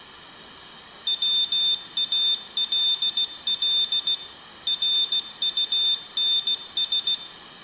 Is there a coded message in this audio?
Yes: Morse code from 1.0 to 7.2 s, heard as a high beeper, machine-sent, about 16 wpm, 3600 Hz, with room echo. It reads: WALL RUNS